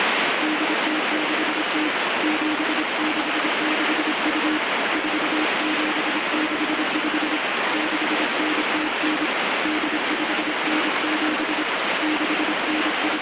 Morse code (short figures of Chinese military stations), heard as a keyed tone, hand-sent with a paddle, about 26 wpm, 310 Hz, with heavy radio static. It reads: 8060 7662 4765 6909 8597 …